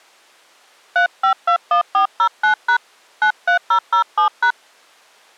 DTMF, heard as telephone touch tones, dialled by hand, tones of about 90 ms. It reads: 3521409# 93007#